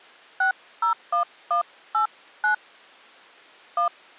DTMF, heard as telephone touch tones, dialled by hand, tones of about 110 ms. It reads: 601189 1